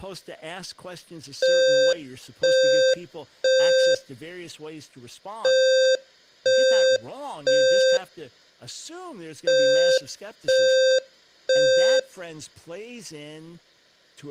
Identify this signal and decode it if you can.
Alarm pattern, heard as an alarm's beeps, played three times, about 520 Hz, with room echo and speech in English. Temporal three. Smoke or fire, evacuate.